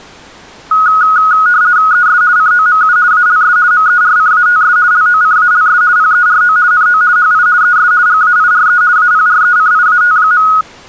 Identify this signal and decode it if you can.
RTTY (50 baud, 170 Hz shift), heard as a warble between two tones, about 1360 Hz centre. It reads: ES COMU ALS MERCATS LOCALS PERO NO HI ES GAIRE APRECIAT.